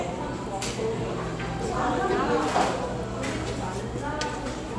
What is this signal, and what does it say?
The noise of a cafe. There is no code.